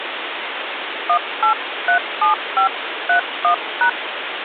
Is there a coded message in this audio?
Yes: DTMF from 1.1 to 3.9 s, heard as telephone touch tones, dialled by hand, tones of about 100 ms, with phone line noise. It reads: 1837531#